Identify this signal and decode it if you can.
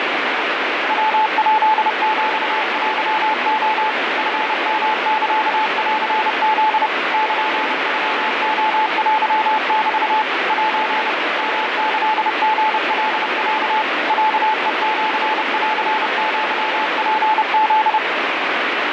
Morse code (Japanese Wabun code), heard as a keyed tone, machine-sent, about 30 wpm, 870 Hz, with heavy radio static. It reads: ヤヱヒテレ チヨサンフ ルノレテメ セ ヨキリカロ ロヘシンアツフ